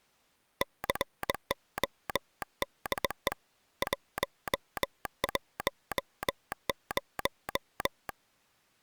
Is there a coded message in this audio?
Yes: Morse code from 0.6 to 8.2 s, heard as a telegraph sounder, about 21 wpm. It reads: CODE 110